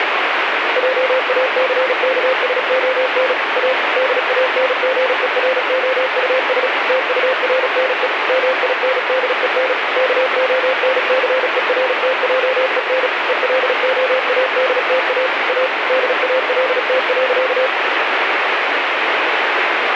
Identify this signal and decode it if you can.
Morse code, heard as a keyed tone, machine-sent, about 36 wpm, 520 Hz, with radio static. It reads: JACKSON A DANGEROUS TURNE MINDEN KONCERTJEN ELOADTA A DALT.